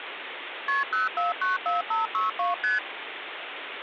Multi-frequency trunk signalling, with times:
0.7-0.8 KP
0.9-2.5 0494562
2.6-2.8 ST

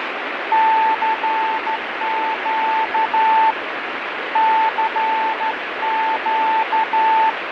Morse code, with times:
0.5-3.5 CQ
4.4-7.3 CQ

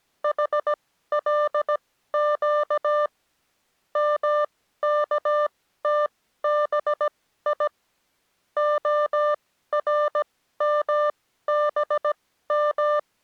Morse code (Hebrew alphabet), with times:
0.2-3.1 חלק
4.0-7.7 מכתבי
8.6-13.0 הרמבם

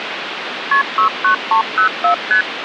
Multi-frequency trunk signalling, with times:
0.7-0.8 KP
1.0-2.1 69304
2.3-2.4 ST

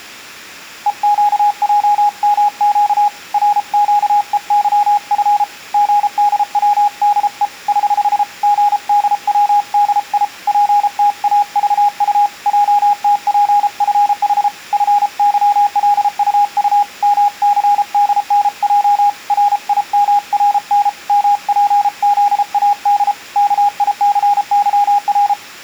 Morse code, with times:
0.9-3.1 EQJMQ
3.3-5.4 RQEYF
5.7-7.5 GDWDE
7.7-8.2 <HH>
8.4-10.2 GDWDI
10.5-12.3 PTAVU
12.5-14.5 JTPFH
14.7-16.8 FYLUU
17.0-19.1 MCDNJ
19.3-20.9 RIMRN
21.1-23.1 MPZAD
23.4-25.3 KICYR

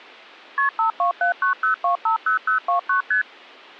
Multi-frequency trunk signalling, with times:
0.6-0.7 KP
0.8-3.0 52790250029
3.1-3.2 ST

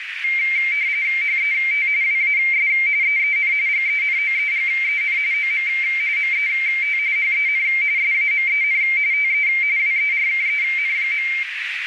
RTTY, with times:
1.2-1.9 HET
2.0-2.7 WAS
3.0-3.5 EEN
3.7-5.2 GENOEGEN
5.3-5.7 OM
6.2-7.0 MET
7.2-7.6 HEN
8.0-8.8 SAMEN
9.1-9.5 TE
9.8-11.3 WERKEN.

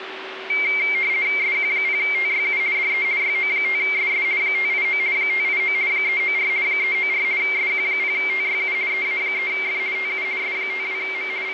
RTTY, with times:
1.4-2.6 SQ0TYU
2.7-3.0 DE
3.2-4.2 YO5SS
4.4-5.0 589
5.1-5.7 589
5.9-6.5 394
6.6-7.2 394
7.4-8.7 SQ0TYU
8.9-9.8 EA3F
9.9-10.2 TU
10.4-11.3 S52M
11.4-11.5 …

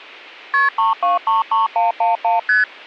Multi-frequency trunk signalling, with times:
0.5-0.7 KP
0.8-2.4 3233111
2.5-2.6 ST

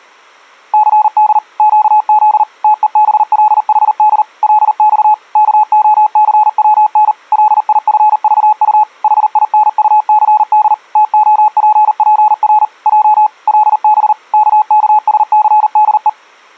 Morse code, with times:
0.7-1.4 CD
1.6-2.4 QZ
2.6-4.2 TEBLHD
4.4-5.1 LX
5.4-7.1 KOCWN
7.3-8.8 LIFVU
9.0-10.7 HINUCD
11.0-12.6 TOPPR
12.9-13.3 J
13.5-14.1 LB
14.3-16.1 KKSCDE

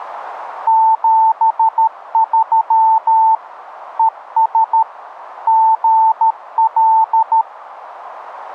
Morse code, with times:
0.7-3.3 73
4.0-4.8 ES
5.5-7.4 GL

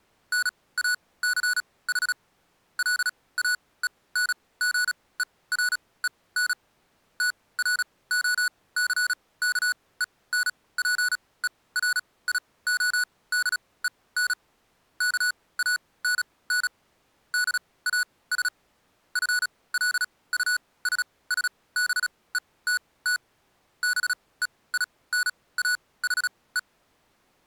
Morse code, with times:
0.3-2.1 NACH
2.8-6.5 LAENGEREN
7.2-14.3 TROCKENPERIODEN
15.0-16.7 KANN
17.3-18.5 DAS
19.2-23.2 FLUSSBETT
23.8-26.6 BEINAHE

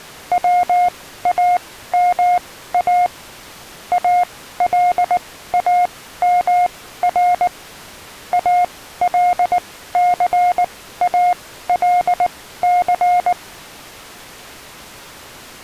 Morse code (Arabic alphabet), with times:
0.3-3.1 واما
3.9-7.5 الامر
8.3-13.3 الثالث

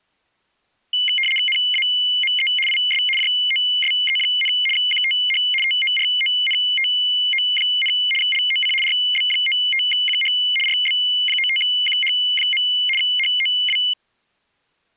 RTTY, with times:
1.5-2.5 NAME
2.7-3.0 IS
3.2-4.5 JOSE,
4.8-5.4 QTH
5.6-7.9 TORONTO,
8.2-8.7 LOC
8.8-10.3 RB95QH
10.7-12.6 RB95QH.
13.0-13.8 HOW

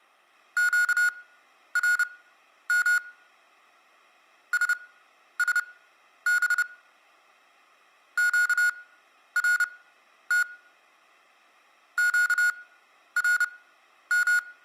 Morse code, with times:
0.6-3.0 QRM
4.5-6.6 SSB
8.2-10.4 QRT
12.0-14.4 QRM

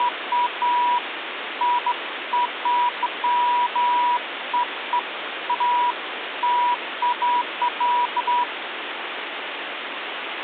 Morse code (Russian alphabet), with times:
none

